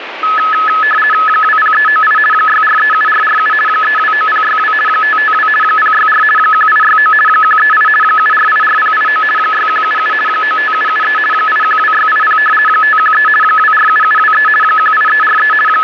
RTTY (50 baud, 450 Hz shift), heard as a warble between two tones, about 1500 Hz centre, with radio static. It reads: 20398 6437447 329062 552 064 1869 138 7484089 6177 95773 812680 513 247723 18343 …